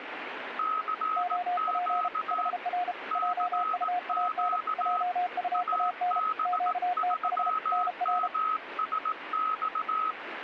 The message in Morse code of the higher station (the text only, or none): CQ CQ AB3MSX